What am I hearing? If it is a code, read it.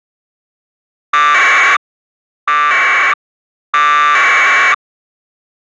Packet radio (AX.25, as in APRS), 1200 baud, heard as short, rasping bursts.